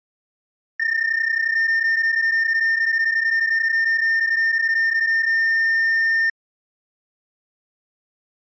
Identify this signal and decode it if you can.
PSK31 (31.25 baud), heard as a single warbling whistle, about 1800 Hz.